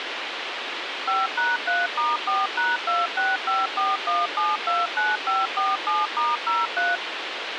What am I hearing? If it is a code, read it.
DTMF, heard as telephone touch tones, dialled by machine, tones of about 190 ms, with radio hiss and a squelch burst at the end. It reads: 5#3*4#26541729547*03